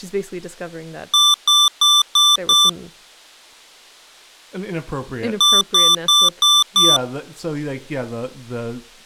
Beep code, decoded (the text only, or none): 5 short